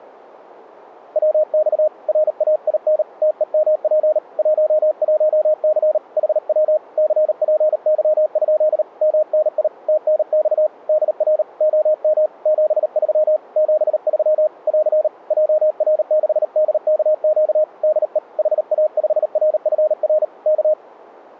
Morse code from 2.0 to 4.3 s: RAIN TEMP

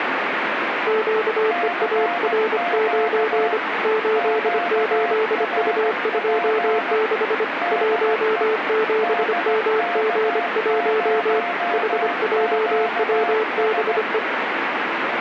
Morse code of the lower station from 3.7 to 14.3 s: 88U26 17MG1 HJWBE

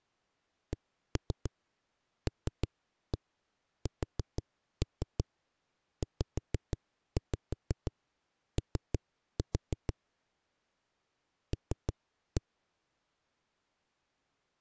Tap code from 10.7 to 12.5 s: L

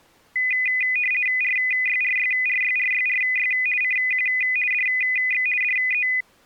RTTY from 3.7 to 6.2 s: CQ DX DE

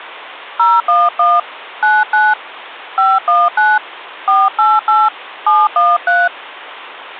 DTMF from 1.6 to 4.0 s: 99 519

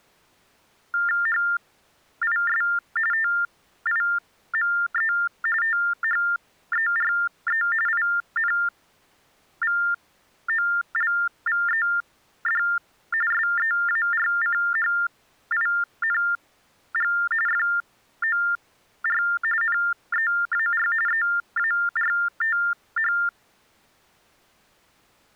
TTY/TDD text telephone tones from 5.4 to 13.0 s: THERE INVOLVED

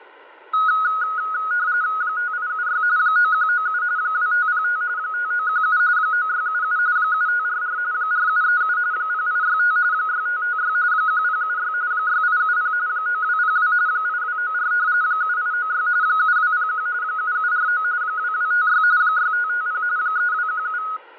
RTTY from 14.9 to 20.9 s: 7896 7201 7749 2256 6550 3217

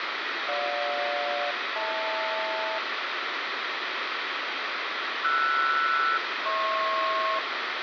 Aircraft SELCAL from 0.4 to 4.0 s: GJ-HL

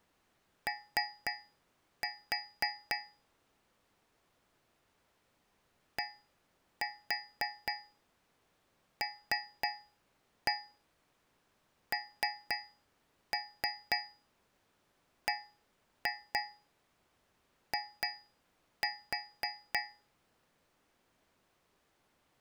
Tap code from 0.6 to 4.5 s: O

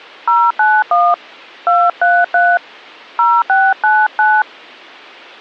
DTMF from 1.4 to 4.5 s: 233 0699

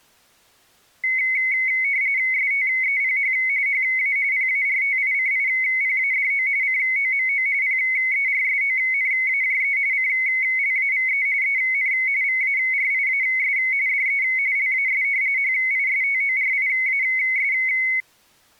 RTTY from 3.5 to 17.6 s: HA PARTICIPADO COMO PERSONAJE CLAVE EN VARIAS DE LAS HISTORIAS

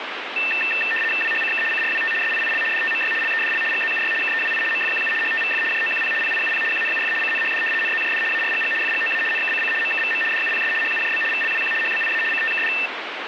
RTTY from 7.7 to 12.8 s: NZJD ARGG FGOA NKCC MKVM DUPS HUJB VLWQ HBIA CTKD

